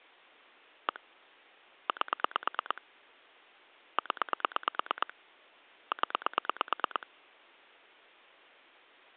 Pulse dialling, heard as clicks on a phone line, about 9 pulses a second. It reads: 1 8 0 0